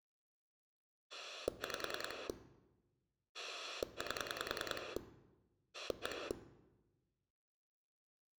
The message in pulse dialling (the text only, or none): 5 8 1